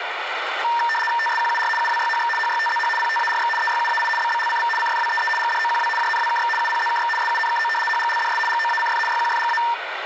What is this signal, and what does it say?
RTTY (75 baud, 850 Hz shift), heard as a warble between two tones, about 1360 Hz centre, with radio static. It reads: TSQUR UWYHX HYTZH PTARX EYUAI BBLCV CFWEE GDOQW JNWKX UPZKX SUNKO HGLDS GOACF YQFGA